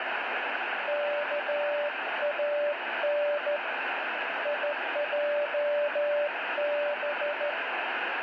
Morse code (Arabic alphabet), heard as a keyed tone, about 13 wpm, 590 Hz, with heavy radio static. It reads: كان يجب